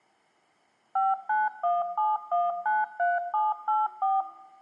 DTMF, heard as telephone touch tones, dialled by machine, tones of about 190 ms, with room echo. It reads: 5917193784